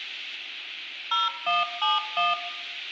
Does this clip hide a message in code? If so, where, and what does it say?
Yes: DTMF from 1.1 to 2.3 s, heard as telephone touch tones, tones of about 170 ms, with hum and room echo. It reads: 0171